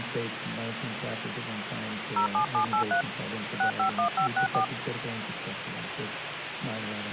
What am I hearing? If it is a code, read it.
DTMF, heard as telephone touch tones, dialled by hand, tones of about 100 ms, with phone line noise. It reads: 07783 651564